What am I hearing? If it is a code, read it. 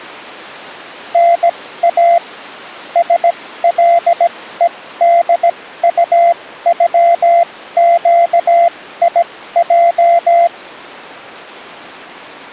Morse code (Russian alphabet), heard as a keyed tone, machine-sent, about 17 wpm, spaced as for 14 wpm, 690 Hz. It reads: НА СЛЕДУЮЩИЙ